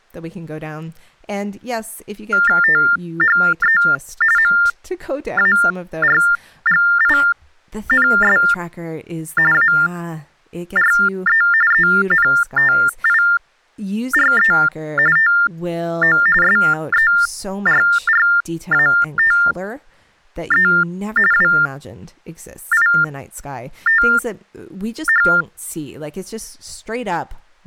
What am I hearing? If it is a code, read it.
TTY/TDD text telephone tones (45.45 baud Baudot), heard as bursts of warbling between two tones, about 400 Hz shift, 1600 Hz centre, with speech in English. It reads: THE MARGINS ARE ENTIRE TO SERRATE WITH